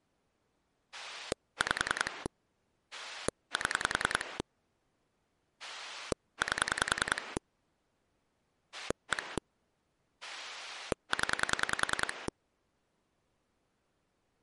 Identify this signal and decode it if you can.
Pulse dialling, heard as a rotary dial, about 10 pulses a second. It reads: 5 7 8 1 0